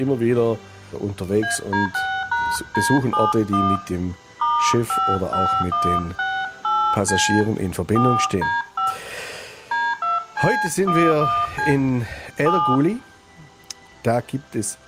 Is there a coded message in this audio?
Yes: DTMF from 1.4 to 12.8 s, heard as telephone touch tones, dialled by hand, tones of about 230 ms, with room echo. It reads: AD6#D71 *55168C 4D5 D2C11C 7